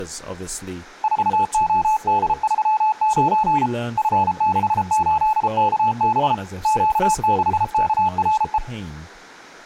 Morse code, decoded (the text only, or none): 4OD39 F68KB Q6KRE